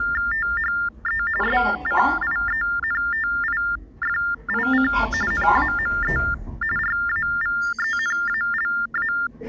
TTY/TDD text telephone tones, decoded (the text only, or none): THE SCIENTIFIC NAME RAVENALA